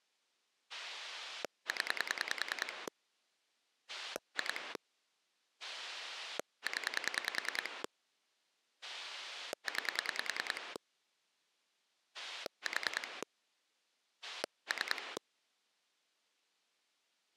Pulse dialling, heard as a rotary dial, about 10 pulses a second. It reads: 0 2 0 9 4 3